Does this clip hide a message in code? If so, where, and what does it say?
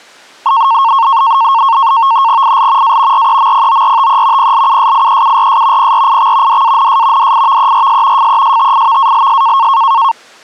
Yes: NAVTEX (SITOR-B), 100 baud, 170 Hz shift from 0.5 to 10.1 s, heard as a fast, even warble, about 1000 Hz centre. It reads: IL A REMPORTE PLUSIEURS PRIX DANS DIVERS FESTIVALS